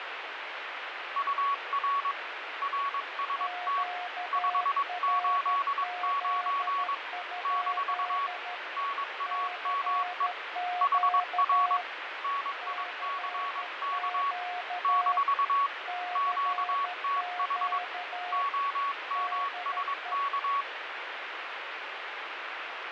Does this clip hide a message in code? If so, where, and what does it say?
Yes: Morse code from 1.1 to 20.7 s, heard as two keyed tones, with radio static and fading. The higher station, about 22 wpm, 1120 Hz: UR RST 589 - NAME HR NICK - QTH OMSK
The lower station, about 13 wpm, 720 Hz: QRZ? CQ CQ CQ DE